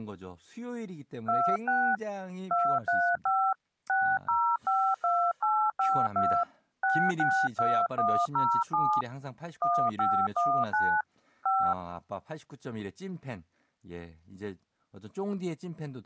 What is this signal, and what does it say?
DTMF, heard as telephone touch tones, dialled by hand, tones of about 280 ms, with speech in Korean. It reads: 26 235 6052852 662107 1519 5